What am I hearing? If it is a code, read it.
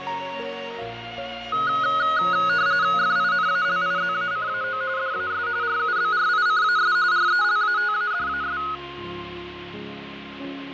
RTTY (45.45 baud, 170 Hz shift), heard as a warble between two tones, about 1360 Hz centre, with radio static and fading. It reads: FINALIZACAO DAS RUBRICAS RELATADAS